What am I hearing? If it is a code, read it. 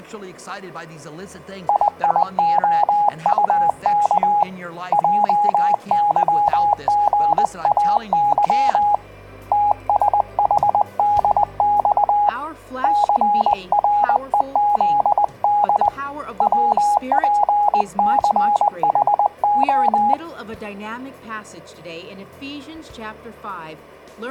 Morse code, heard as a keyed tone, hand-sent with a paddle, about 20 wpm, 830 Hz. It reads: IIOUK JYGAY TSHDX CREZD WPCHO